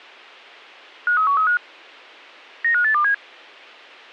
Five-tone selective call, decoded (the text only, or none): 53135 95827